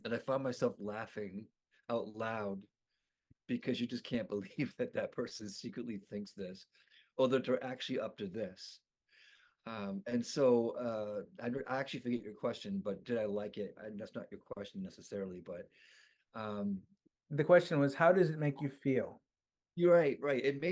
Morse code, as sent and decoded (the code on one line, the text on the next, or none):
none